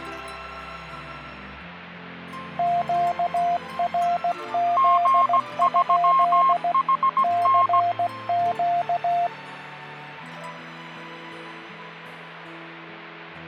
Morse code, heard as two keyed tones. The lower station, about 16 wpm, 700 Hz: QRZ? CQ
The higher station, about 17 wpm, 1070 Hz: G3HN